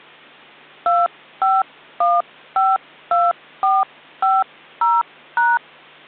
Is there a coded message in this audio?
Yes: DTMF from 0.9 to 5.6 s, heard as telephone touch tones, dialled by hand, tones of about 200 ms. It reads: 25152450#